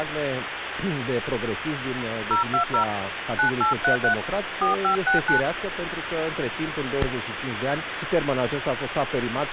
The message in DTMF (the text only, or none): 020 9833 4569